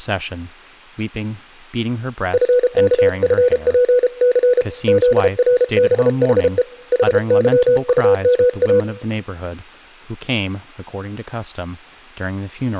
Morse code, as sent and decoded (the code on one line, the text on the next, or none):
..-. -.- ..-. .--. -.-. / --.. .-. -... .... . / .... -.-- ..- -- .-
FKFPC ZRBHE HYUMA